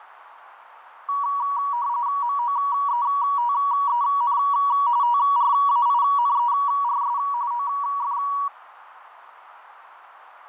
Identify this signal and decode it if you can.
RTTY (45.45 baud, 170 Hz shift), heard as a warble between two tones, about 1040 Hz centre, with radio static. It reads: MOETEN TRAINERS OF